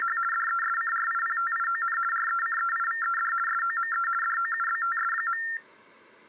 RTTY (50 baud, 450 Hz shift), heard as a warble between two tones, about 1600 Hz centre. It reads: … DESCRIPTION RECEIVED SOME DOUBTS.